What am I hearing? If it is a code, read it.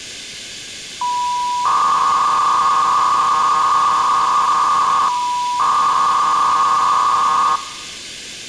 300-baud modem data (V.21 tones), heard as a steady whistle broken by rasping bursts, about 300 baud, 200 Hz shift.